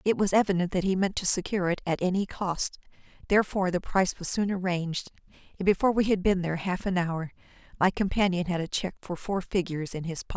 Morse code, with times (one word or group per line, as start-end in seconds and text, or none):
none